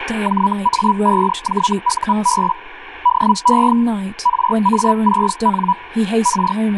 Hellschreiber (Feld-Hell, 122.5 baud), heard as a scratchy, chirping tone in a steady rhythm, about 980 Hz, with radio static and speech in English. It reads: JA5JUB DE RA6N R